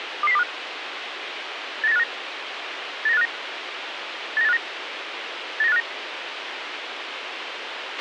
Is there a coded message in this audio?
Yes: five-tone selective call (EEA) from 0.2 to 5.8 s, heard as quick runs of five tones, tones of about 40 ms, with radio hiss and a squelch burst at the end. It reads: 22025 89859 89859 89859 89859